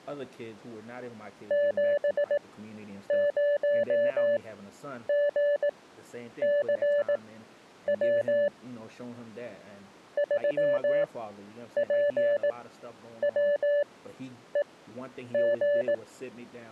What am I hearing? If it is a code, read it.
Morse code, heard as a keyed tone, machine-sent, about 18 wpm, spaced as for 9 wpm, 580 Hz, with speech in English. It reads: 70GCW 3PWEG